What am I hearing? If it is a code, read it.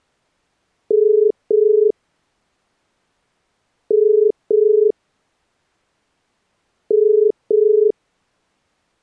Telephone call progress tone (as in the UK, Ireland, Australia and similar networks), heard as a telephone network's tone, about 430 Hz. Ringback tone.